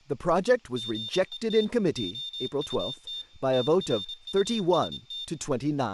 Morse code, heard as a high beeper, machine-sent, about 26 wpm, 3600 Hz, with speech in English. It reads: GET OUT TRUST